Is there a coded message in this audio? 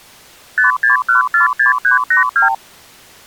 Yes: multi-frequency trunk signalling (R2, with the far end's replies) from 0.6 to 2.5 s, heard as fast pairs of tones, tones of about 130 ms. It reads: 56146382